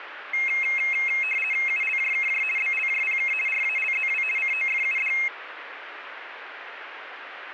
RTTY (50 baud, 450 Hz shift), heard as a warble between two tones, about 2350 Hz centre, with radio static. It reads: ULJKJ BLJPK RALZW COFUD